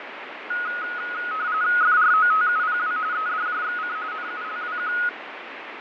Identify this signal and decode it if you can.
RTTY (45.45 baud, 170 Hz shift), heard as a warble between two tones, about 1360 Hz centre, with radio static and fading. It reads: FROTUPW EDJXC NULWQ